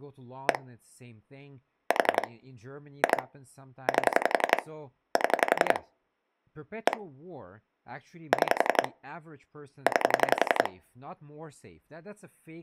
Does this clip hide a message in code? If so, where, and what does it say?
Yes: pulse dialling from 0.5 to 10.7 s, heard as clicks on a phone line, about 11 pulses a second, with speech in English. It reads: 1 4 2 8 7 1 6 9